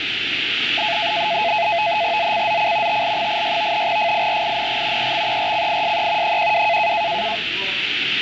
NAVTEX (SITOR-B), 100 baud, 170 Hz shift, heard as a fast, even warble, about 770 Hz centre, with radio static and the noise of a cafe. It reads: ZCZC TL86 FIRING EXERCISE 12